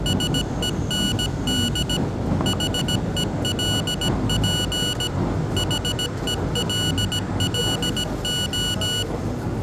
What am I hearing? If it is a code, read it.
Morse code, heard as electronic beeps, machine-sent, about 17 wpm, 1470 Hz, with room echo and the noise inside a subway train. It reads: SEND HELP HELLO